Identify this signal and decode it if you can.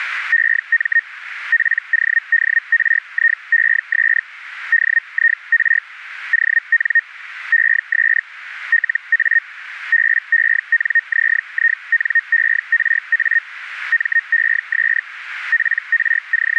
Hellschreiber (Feld-Hell, 122.5 baud), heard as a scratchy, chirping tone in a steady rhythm, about 1850 Hz, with radio static. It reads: EM PODRIES DIR ON ES LA BENZINERA MES …